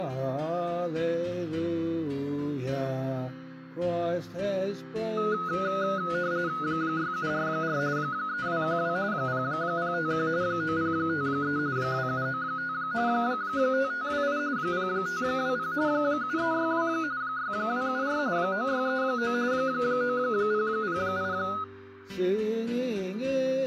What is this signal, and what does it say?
RTTY (45.45 baud, 170 Hz shift), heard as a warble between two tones, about 1360 Hz centre. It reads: 6744 3212 0051 9053 2795 5528 0520 7362 6274 9639 9008